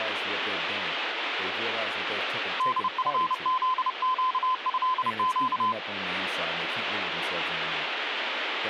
Morse code (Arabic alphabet), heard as a keyed tone, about 30 wpm, 1020 Hz, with radio static and speech in English. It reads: دفذقهق